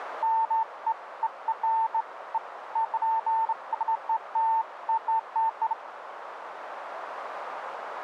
Beeps of irregular length, with radio static and a narrow filter. There is no code.